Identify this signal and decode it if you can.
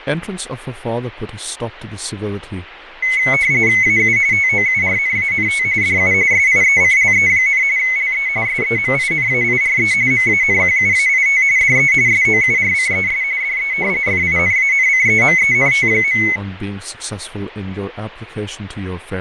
RTTY (45.45 baud, 170 Hz shift), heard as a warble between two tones, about 2150 Hz centre, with radio static, fading and speech in English. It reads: AU TOURNANT DU SIECLE, LE SEMINAIRE MANQUAIT DE SOURCES DE FINANCEMENT.